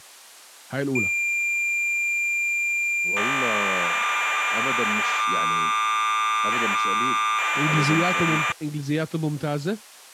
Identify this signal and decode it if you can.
Cassette data (Kansas City type), 1200 baud, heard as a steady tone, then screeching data, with speech in Arabic.